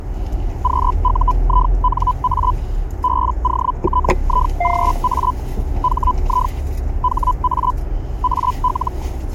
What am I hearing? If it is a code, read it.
Hellschreiber (Feld-Hell, 122.5 baud), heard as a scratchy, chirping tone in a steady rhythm, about 1000 Hz, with the noise inside a car. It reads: QUINA BOTIGA HI HA AL